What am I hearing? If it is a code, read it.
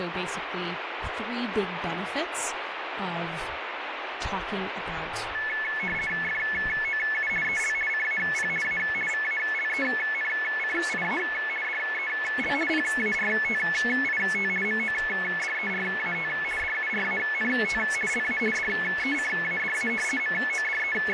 RTTY (50 baud, 450 Hz shift), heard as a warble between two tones, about 1950 Hz centre, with radio static and speech in English. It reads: FOU EL CAP A VALENCIA DEL PARTIT MODERAT DURANT LA DECADA …